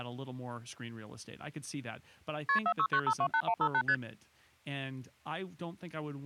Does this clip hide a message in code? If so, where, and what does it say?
Yes: multi-frequency trunk signalling (R1, as on North American trunks) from 2.5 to 3.9 s, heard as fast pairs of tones, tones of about 70 ms, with speech in English. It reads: KP 469528158 ST